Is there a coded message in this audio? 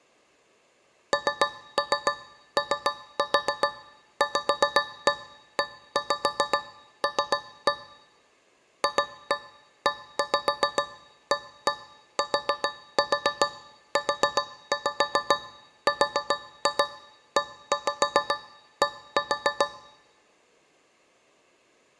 Yes: tap code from 1.1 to 19.8 s, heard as taps on a metal pipe, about 7 knocks a second. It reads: NOVEL FEATURED